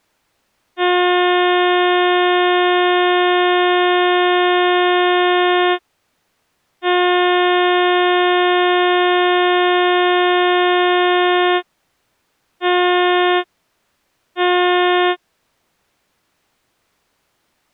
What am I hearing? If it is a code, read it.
Ship horn signal, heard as a ship's horn, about 360 Hz. 2 long, 2 short. At sea: I intend to overtake on your port side.